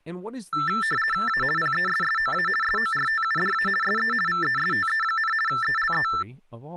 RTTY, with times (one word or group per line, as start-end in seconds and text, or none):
1.3-1.4 A
1.6-2.5 PESSOA
2.6-3.7 SORTUDA
3.8-4.1 SE
4.3-5.3 VESTE,
5.5-6.1 ELE